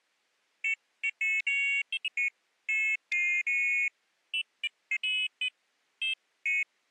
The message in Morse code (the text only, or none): none